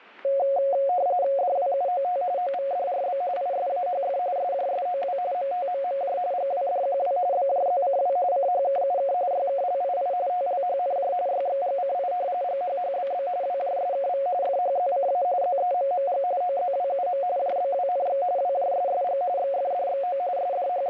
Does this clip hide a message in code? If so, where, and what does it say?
Yes: RTTY (45.45 baud, 170 Hz shift) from 0.2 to 20.9 s, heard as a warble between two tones, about 640 Hz centre, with static crashes. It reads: DWUOT OVDRB ISAHF SJSOW MTMMJ GWDQW BJZCW CHKUK YKLII TLHNJ YXGCI GHHBB WJSKV FHZCA ZEMMG OZWUM JBWNX WJSSG XFDXO …